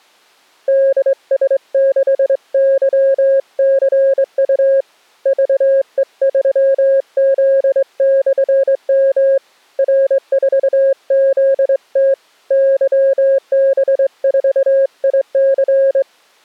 Morse code, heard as a keyed tone, hand-sent with a straight key, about 23 wpm, 540 Hz. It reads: DS6YCU VE3Z/M R4ZT YB4IC